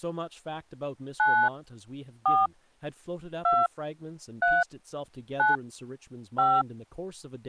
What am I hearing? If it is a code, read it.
DTMF, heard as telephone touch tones, dialled by hand, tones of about 240 ms, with speech in English. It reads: 9 4 2 3 9 5